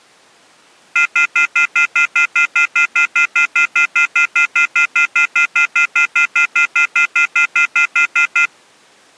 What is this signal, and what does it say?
Telephone call progress tone (North American plan), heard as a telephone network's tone, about 1400, 2050, 2450, 2600 Hz, 0.1 s on and 0.1 s off. Off-hook warning tone.